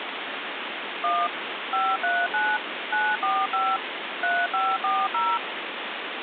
DTMF, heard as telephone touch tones, dialled by machine, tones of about 230 ms, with phone line noise. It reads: 1 539 945 3540